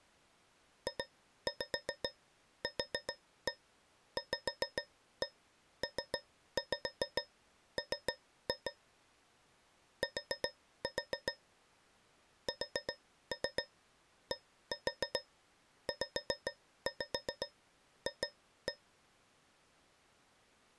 Tap code, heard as taps on a metal pipe, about 7 knocks a second. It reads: JQVPM T SDZF